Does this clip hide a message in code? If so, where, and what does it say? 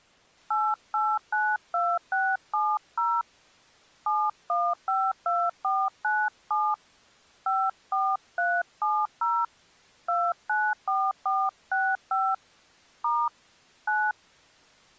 Yes: DTMF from 0.5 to 14.1 s, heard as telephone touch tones, dialled by hand, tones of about 240 ms. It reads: 8892670 7152497 54370 294465 * 9